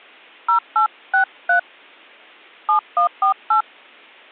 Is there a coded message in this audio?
Yes: DTMF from 0.5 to 3.6 s, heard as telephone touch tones, dialled by hand, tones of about 110 ms. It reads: 0863 7148